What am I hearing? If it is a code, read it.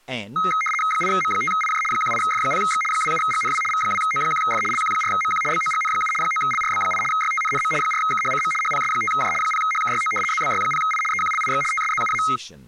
RTTY (75 baud, 850 Hz shift), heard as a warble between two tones, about 1700 Hz centre, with speech in English. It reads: 8M5IJ 18F0X 27GNW V2O1F LQ4MQ BOGN7 9LRB8 YTNNM 4KHCM HPS5J 0HKYO ZBY0I EQLIX TSZUA